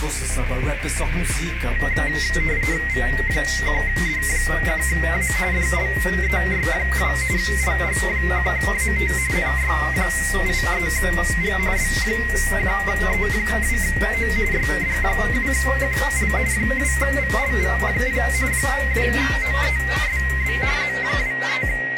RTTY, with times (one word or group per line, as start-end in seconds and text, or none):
2.9-5.3 V1D1A
5.5-7.1 DLEY2
7.4-9.1 LG1AT
9.3-11.6 NY83G
11.8-14.3 B1E2O
14.5-16.3 YD7QL
16.5-18.2 2VLV0
18.5-20.6 2OESB
20.8-22.0 …